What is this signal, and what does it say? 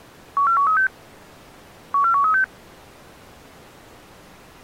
Five-tone selective call (CCIR), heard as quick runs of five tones, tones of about 100 ms. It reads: 14136 14136